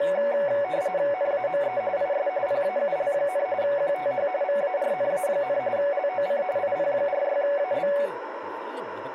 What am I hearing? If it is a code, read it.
RTTY (45.45 baud, 170 Hz shift), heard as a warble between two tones, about 660 Hz centre, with radio static, a narrow filter and speech in Malayalam. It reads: NAME IS PAUL, QTH VARNA, LOC IP46AB